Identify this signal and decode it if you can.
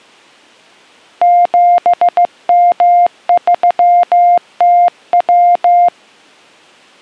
Morse code, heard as a keyed tone, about 15 wpm, 700 Hz. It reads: 7M3TW